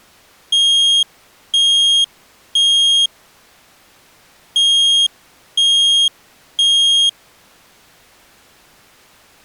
Alarm pattern, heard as an alarm's beeps, played twice, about 3250 Hz. Temporal three. Smoke or fire, evacuate.